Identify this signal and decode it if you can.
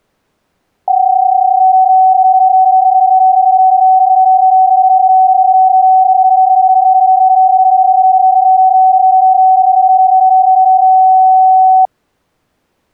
PSK31 (31.25 baud), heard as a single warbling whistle, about 750 Hz.